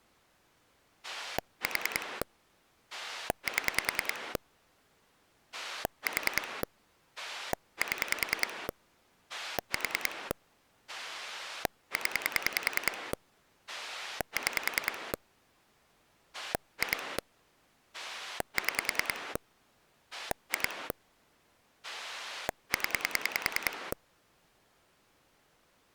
Pulse dialling, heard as a rotary dial, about 10 pulses a second. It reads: 4 7 4 7 4 0 6 2 6 2 0